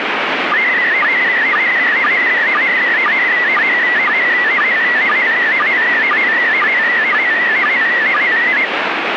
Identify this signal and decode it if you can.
SSTV (slow-scan television), PD 120, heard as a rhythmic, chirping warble, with radio static.